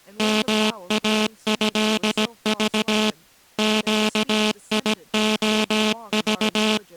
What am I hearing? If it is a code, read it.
Morse code (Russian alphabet), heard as a buzzer, machine-sent, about 17 wpm, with speech in English. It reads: МАЭЖ ЩИОЖ